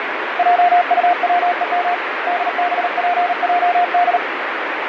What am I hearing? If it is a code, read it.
Morse code, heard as a keyed tone, hand-sent with a paddle, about 38 wpm, 710 Hz, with heavy radio static. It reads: JUWEM DBPJD